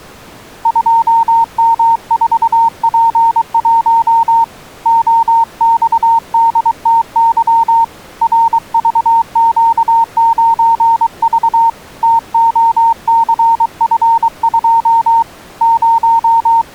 Morse code, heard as a keyed tone, hand-sent with a paddle, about 23 wpm, 920 Hz. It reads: 2M4P1 OXDTY RVQ9V TOCF2 …